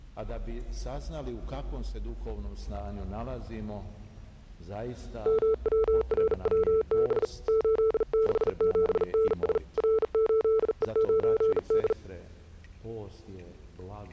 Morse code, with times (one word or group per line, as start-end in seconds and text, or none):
5.3-7.2 MWRWB
7.5-9.6 867NS
9.8-11.9 R8E9D